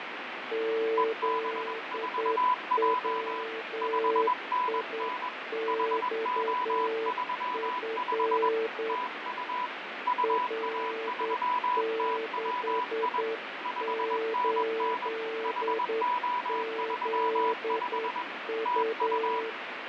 Morse code, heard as two keyed tones, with heavy radio static and fading. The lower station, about 9 wpm, 450 Hz: ZWIXF R68ZU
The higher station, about 21 wpm, 990 Hz: EB4J 5NN HO35 TU UA3TWI 5NN HO35 TU